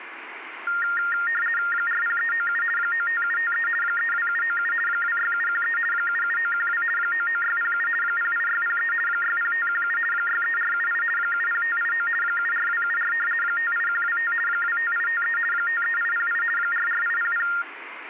RTTY (50 baud, 450 Hz shift), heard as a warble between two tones, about 1600 Hz centre, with radio static. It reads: 40397 95753 32797 26713 77912 99607 08603 60517 63478 70589 74274 58125 25853 53808 44800